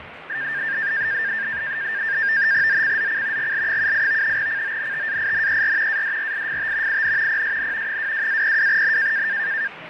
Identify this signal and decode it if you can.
NAVTEX (SITOR-B), 100 baud, 170 Hz shift, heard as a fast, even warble, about 1700 Hz centre, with radio static, fading and the noise of a crowd indoors. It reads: ZCZC GL78 CONTAINER ADRIFT IN PSN 22-02N